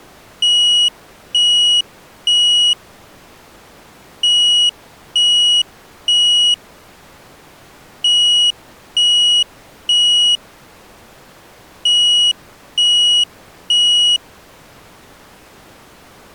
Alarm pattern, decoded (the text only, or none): temporal three